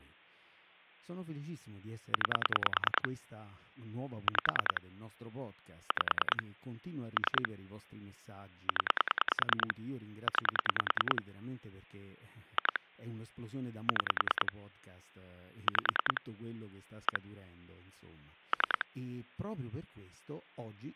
Pulse dialling, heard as clicks on a phone line, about 10 pulses a second, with hum and speech in Italian. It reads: 9 5 5 3 0 9 2 6 5 1 3